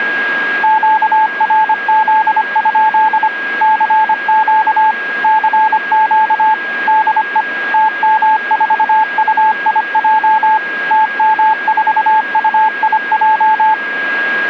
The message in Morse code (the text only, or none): QRZ? CQ CQ DE TM4UIJ TM4UIJ